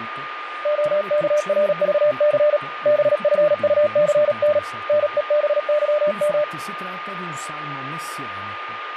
Morse code, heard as a keyed tone, hand-sent with a paddle, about 37 wpm, 600 Hz, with radio static, a steady whistle near 1220 Hz and speech in Italian. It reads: OKRVC BFUCN NEBYM